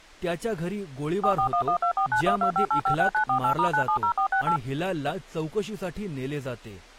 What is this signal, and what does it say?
DTMF, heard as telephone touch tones, dialled by machine, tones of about 90 ms, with speech in Marathi. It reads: 4411249125856948*970468